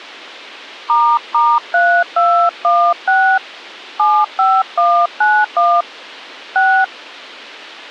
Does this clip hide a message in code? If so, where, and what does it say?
Yes: DTMF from 0.9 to 6.8 s, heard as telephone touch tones, dialled by hand, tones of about 280 ms. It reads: **3216 75191 6